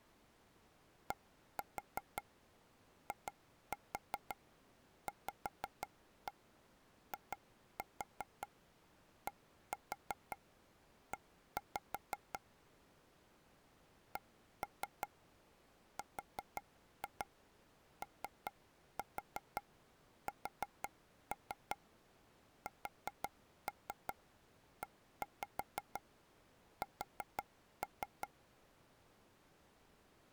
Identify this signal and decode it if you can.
Tap code, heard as taps on a table, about 5 knocks a second. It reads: DIVIDE CROSSES